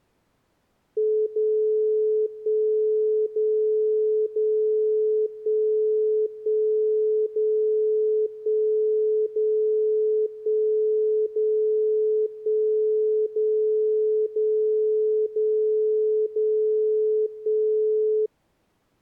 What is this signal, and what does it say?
Radio time signal (DCF77), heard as a tone whose level steps once a second, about 430 Hz. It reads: 0 1 0 0 1 1 0 1 0 1 0 1 0 0 0 0 1